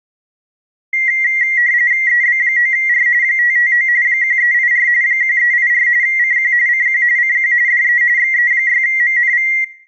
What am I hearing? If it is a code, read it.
RTTY (45.45 baud, 170 Hz shift), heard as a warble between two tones, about 2000 Hz centre, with room echo. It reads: EB9R 559 1384 1384 CQ CQ CQ DE XE6MNV